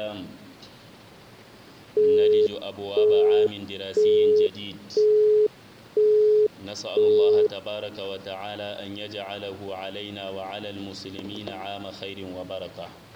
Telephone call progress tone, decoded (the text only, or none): busy tone